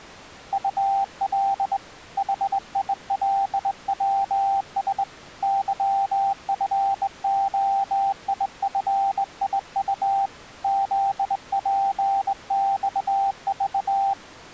Morse code, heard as a keyed tone, hand-sent with a straight key, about 20 wpm, 790 Hz. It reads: UL HILWS YFOIFIU ZPXV